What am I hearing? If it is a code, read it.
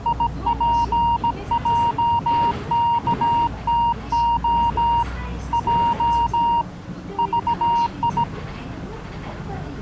Morse code, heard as a keyed tone, hand-sent with a bug key, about 17 wpm, 940 Hz, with the noise inside a bus. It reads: IPJKTO J VI